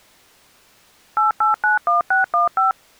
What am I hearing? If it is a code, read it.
DTMF, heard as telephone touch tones, dialled by machine, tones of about 140 ms. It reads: 8891615